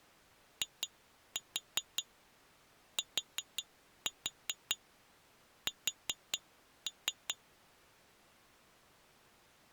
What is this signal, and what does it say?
Tap code, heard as taps on glass, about 5 knocks a second. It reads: ITS